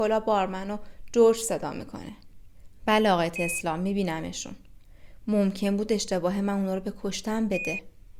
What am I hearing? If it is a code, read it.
Quindar tones, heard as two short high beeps, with speech in Persian.